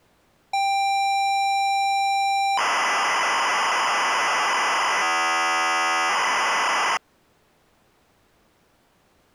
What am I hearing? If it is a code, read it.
ZX Spectrum tape loading, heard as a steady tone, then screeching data.